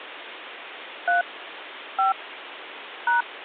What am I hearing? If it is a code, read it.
DTMF, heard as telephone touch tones, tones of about 140 ms, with phone line noise. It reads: 3 5 #